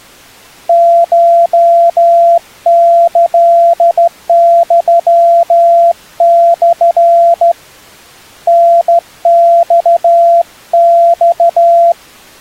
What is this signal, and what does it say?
Morse code (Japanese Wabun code), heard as a keyed tone, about 14 wpm, 680 Hz. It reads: コキユモ タママ